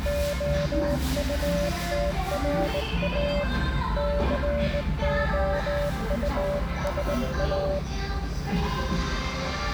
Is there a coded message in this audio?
Yes: Morse code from 0.0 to 7.8 s, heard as a keyed tone, hand-sent with a straight key, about 19 wpm, 580 Hz, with the noise of a restaurant. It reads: OUTRA COUSA